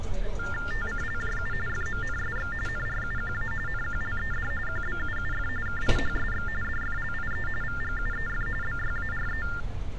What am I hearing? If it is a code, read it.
TTY/TDD text telephone tones (45.45 baud Baudot), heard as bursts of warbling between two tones, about 400 Hz shift, 1600 Hz centre, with street noise. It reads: TCLJU FMNSX NRUQA NQLED QBUUF KIHSX DFLIE VGUEF BYARE